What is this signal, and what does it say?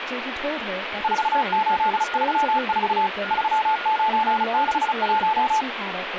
Morse code, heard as a keyed tone, machine-sent, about 35 wpm, 870 Hz, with radio static, a weaker station near 1430 Hz and speech in English. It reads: 4834 3961